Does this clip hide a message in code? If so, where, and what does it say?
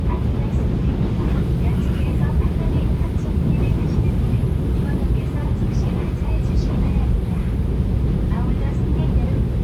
No, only the noise inside a subway train.